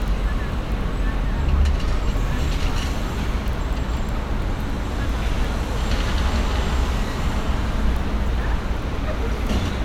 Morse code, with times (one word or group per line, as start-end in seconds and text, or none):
none